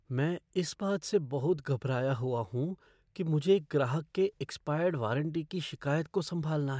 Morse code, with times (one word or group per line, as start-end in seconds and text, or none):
none